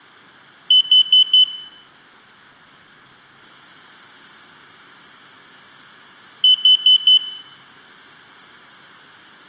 Alarm pattern, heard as an alarm's beeps, played twice, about 3000 Hz, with room echo. Temporal four. Carbon monoxide.